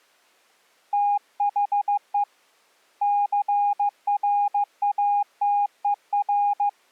Morse code, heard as a keyed tone, hand-sent with a paddle, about 15 wpm, 820 Hz. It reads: THE CRATER